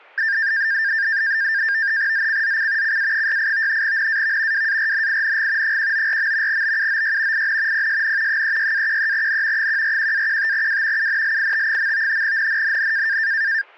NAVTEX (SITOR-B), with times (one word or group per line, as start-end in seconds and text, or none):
2.1-3.0 ZCZC
2.8-3.8 CA68
3.8-4.7 NAV
4.5-5.8 WARNING
5.6-6.6 194.
6.5-7.5 BUOY
7.3-7.9 IN
7.7-8.4 PSN
8.3-9.7 36-13N
9.6-11.1 141-15W
11.0-12.2 UNLIT.
12.2-13.2 NNNN